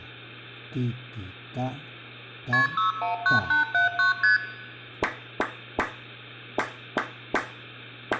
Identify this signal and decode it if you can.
Multi-frequency trunk signalling (R1, as on North American trunks), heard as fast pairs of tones, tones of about 130 ms, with room echo. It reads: KP 619879 ST